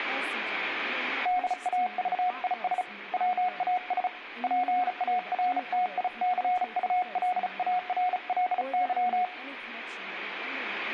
Morse code, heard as a keyed tone, hand-sent with a bug key, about 35 wpm, 730 Hz, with room echo and speech in English. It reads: DAVIS WAS PARTICULARLY